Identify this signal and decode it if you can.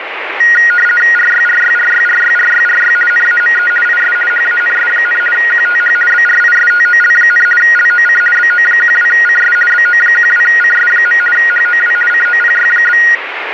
RTTY (50 baud, 450 Hz shift), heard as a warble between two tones, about 1650 Hz centre, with radio static. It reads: RYRYRYRYRYRY NAME IS HANS, QTH BRISTOL, LOC BO12CS BO12CS. HOW COPY?